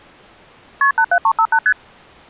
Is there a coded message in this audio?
Yes: multi-frequency trunk signalling (R1, as on North American trunks) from 0.8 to 1.7 s, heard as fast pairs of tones, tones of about 70 ms. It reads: KP 87358 ST